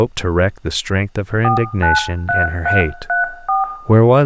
DTMF, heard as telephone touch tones, dialled by hand, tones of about 140 ms, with room echo and speech in English. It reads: 493334